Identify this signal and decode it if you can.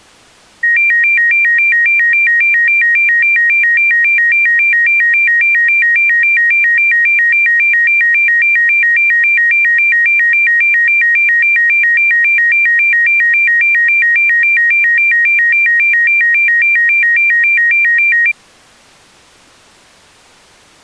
A tone that alternates evenly between two pitches. There is no code.